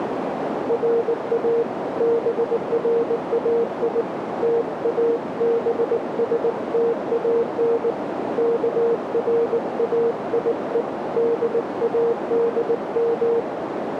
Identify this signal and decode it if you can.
Morse code (Persian alphabet), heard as a keyed tone, hand-sent with a paddle, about 19 wpm, 460 Hz, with radio static and a narrow filter. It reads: را برای تابستان کرایه دادم